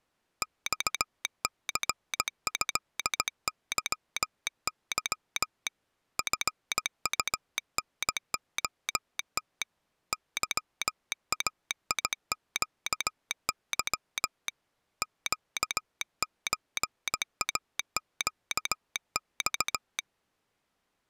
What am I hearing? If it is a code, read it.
Morse code (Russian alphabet), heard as a telegraph sounder, hand-sent with a paddle, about 17 wpm. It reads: ЬЦЭЫЫ ФУНОТ ЫАИЩЫ ЩЧАЩЬ